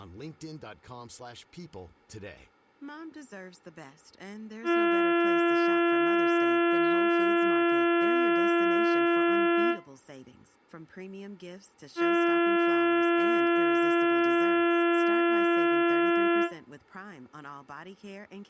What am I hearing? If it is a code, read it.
Ship horn signal, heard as a ship's horn, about 340 Hz, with speech in English. 2 long. At sea: a vessel under power that has stopped in fog.